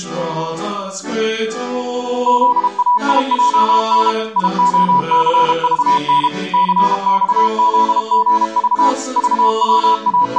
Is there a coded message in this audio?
Yes: Morse code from 2.2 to 10.4 s, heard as a keyed tone, machine-sent, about 32 wpm, 980 Hz. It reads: ZAIJN IOCVN CXZGV …